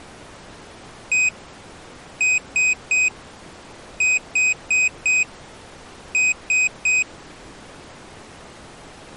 Beep code, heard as a piezo beeper, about 2500 Hz. 1-3-4-3. In Phoenix BIOS tables: memory failure on data bits.